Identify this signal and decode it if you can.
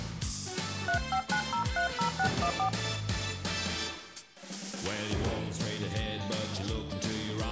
DTMF, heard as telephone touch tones, dialled by hand, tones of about 90 ms, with room echo. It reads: 359030614